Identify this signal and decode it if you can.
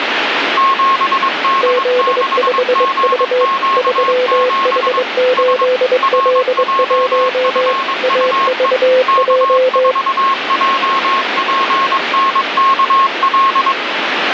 Morse code, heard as two keyed tones, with radio static. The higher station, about 22 wpm, 1080 Hz: 7D6GQ7 S RJFUE K4JPNKL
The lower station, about 23 wpm, 510 Hz: Z5V 3H8L1 AVJ